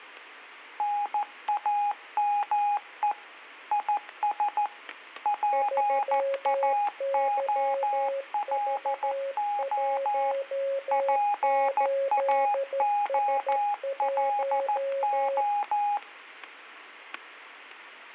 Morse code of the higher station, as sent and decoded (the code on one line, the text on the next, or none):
-. .- -- . / .. ... / .--. .- --- .-.. --- / .--. .- --- .-.. ---
NAME IS PAOLO PAOLO